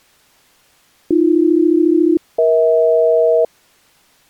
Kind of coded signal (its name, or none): aircraft SELCAL